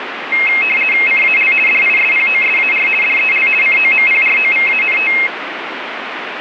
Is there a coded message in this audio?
Yes: RTTY (50 baud, 450 Hz shift) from 0.3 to 5.3 s, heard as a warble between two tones, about 2350 Hz centre, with radio static. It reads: CAL DISPOSAR DEL COMPROVANT